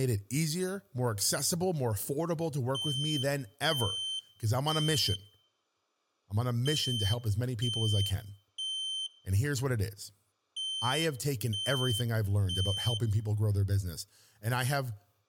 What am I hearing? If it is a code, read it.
Alarm pattern, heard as an alarm's beeps, played three times, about 3100 Hz, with room echo and speech in English. Temporal three. Smoke or fire, evacuate.